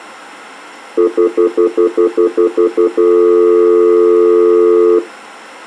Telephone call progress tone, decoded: stutter dial tone

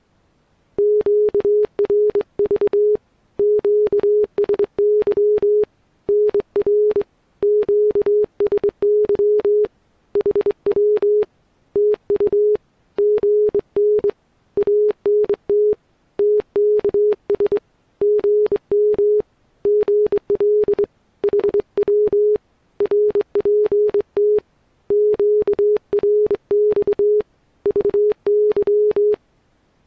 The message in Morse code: QRV QSY NR QSY HW TU GN ANT TKS GM GL HW RPT QRX VY

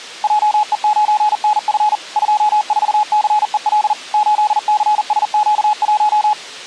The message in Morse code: JE9NF 24CEL 8CSQ1

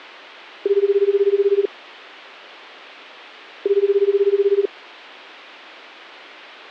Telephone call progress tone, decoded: ringback tone

